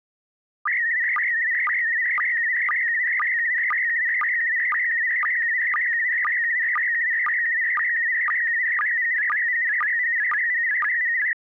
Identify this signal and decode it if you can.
SSTV (slow-scan television), PD 120, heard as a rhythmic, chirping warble.